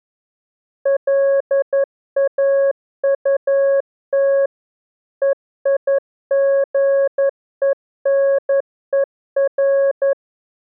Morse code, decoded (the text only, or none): LAUT EIGENER